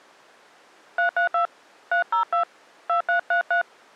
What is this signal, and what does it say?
DTMF, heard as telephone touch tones, dialled by hand, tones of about 110 ms. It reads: 332 302 2333